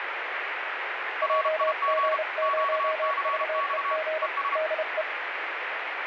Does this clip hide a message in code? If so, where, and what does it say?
Yes: Morse code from 1.2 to 5.1 s, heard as two keyed tones, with radio static. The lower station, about 30 wpm, 630 Hz: JG0VEG DE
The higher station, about 32 wpm, 1120 Hz: RIG QCX ES